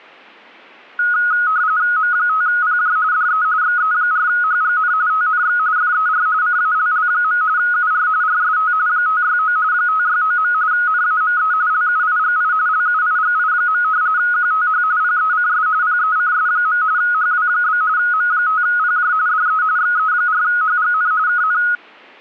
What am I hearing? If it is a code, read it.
RTTY (45.45 baud, 170 Hz shift), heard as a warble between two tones, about 1360 Hz centre. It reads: M5PJ DE XE4HGN TNX FER CALL. UR RST 569 569. NAME LUIGI LUIGI. QTH PECS PECS. HW? M5PJ DE XE4HGN KN